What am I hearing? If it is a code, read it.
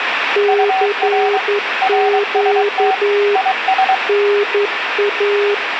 Morse code, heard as two keyed tones, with radio static and room echo. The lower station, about 11 wpm, 410 Hz: CQ NA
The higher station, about 23 wpm, 760 Hz: UR RST IS